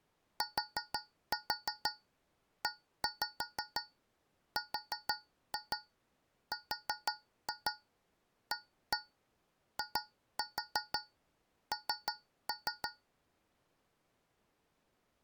Tap code, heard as taps on a metal pipe, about 6 knocks a second. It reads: TERRAIN